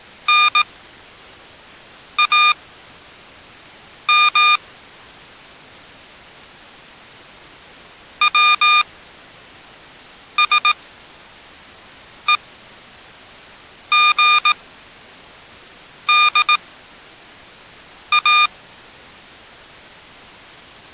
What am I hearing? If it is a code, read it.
Morse code (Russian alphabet), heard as electronic beeps, machine-sent, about 18 wpm, spaced as for 5 wpm, 1210 Hz. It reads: НАМ ВСЕГДА